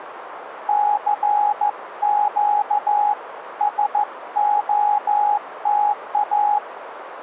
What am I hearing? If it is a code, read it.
Morse code, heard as a keyed tone, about 14 wpm, 830 Hz, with radio static. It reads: CQ SOTA